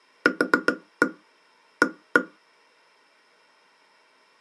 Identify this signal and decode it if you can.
Tap code, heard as taps on a table, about 7 knocks a second. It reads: QA